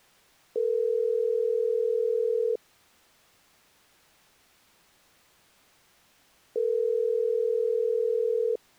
Telephone call progress tone (North American plan), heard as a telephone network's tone, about 440, 480 Hz, 2 s on and 4 s off. Ringback tone.